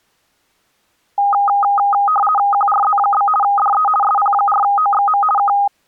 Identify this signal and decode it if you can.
RTTY (50 baud, 450 Hz shift), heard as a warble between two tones, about 1030 Hz centre. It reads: QRZ? DE SP4OXM K